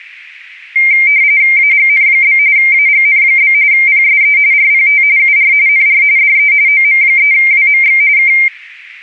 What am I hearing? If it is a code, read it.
RTTY (45.45 baud, 170 Hz shift), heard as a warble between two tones, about 2200 Hz centre, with static crashes. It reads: AGN? AGN? PSE RPT UR NR DE OM3WMX K